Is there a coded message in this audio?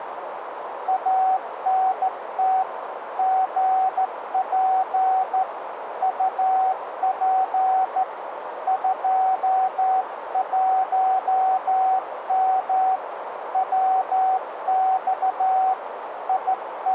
Yes: Morse code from 0.8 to 16.9 s, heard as a keyed tone, hand-sent with a straight key, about 14 wpm, 760 Hz, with radio static and a narrow filter. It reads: ANT GP UP 21M WX …